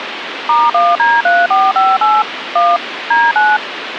DTMF, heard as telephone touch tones, dialled by machine, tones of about 210 ms, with phone line noise. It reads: *1D3458 1 D9